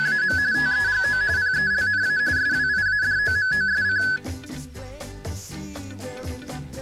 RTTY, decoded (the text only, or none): … TEGO PELNA SWIADOMOSC